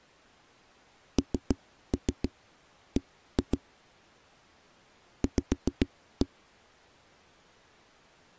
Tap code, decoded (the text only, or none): NB V